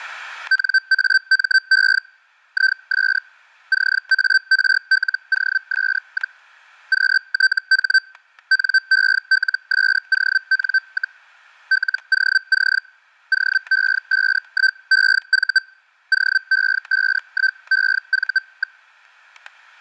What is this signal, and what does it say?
Hellschreiber (Feld-Hell, 122.5 baud), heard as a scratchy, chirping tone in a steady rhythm, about 1550 Hz, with static crashes. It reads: NAME IS CARLOS, QTH NELSON, LOC OE51EV OE51EV.